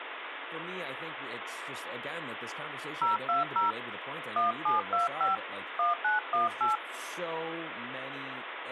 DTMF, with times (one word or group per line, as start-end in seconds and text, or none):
3.0-3.7 020
4.4-5.4 1725
5.8-6.8 1918